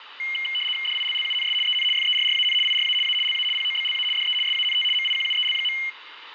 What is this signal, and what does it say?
RTTY (75 baud, 850 Hz shift), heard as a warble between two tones, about 2550 Hz centre, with radio static and room echo. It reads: DILLUNS EN FERRAN IRA A LA POBLA DE SANT MIQUEL.